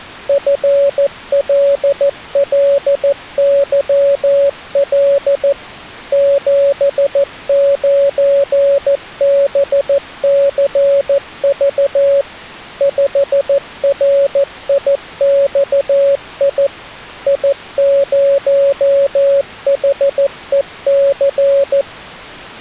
Morse code, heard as a keyed tone, machine-sent, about 14 wpm, 560 Hz. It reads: FLLYL 79BCV 5RIXI I0HEC